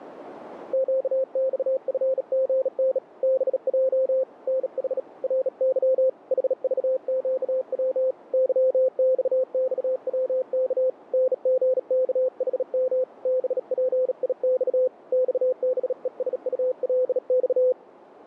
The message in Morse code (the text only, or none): QXFGN BJ NH RY HVQW YXXWK NGKHM BPIX XBESULX